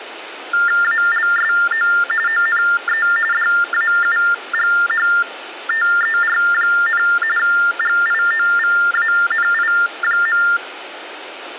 TTY/TDD text telephone tones (45.45 baud Baudot), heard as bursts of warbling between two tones, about 400 Hz shift, 1600 Hz centre, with phone line noise. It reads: ALSO ONE DAUGHTER, GIOVANI.